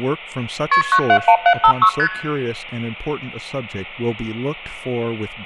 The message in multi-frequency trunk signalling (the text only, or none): KP 971756 ST